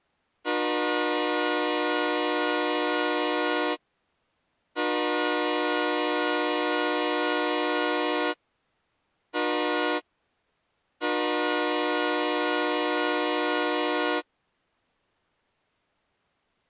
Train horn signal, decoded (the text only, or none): 2 long, 1 short, 1 long